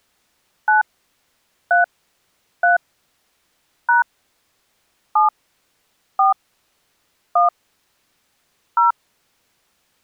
DTMF, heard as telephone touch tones, dialled by hand, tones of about 140 ms. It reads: 9 3 3 # 7 4 1 0